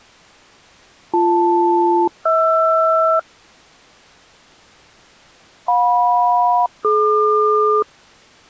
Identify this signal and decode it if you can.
Aircraft SELCAL, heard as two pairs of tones. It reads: BL-HR JM-DQ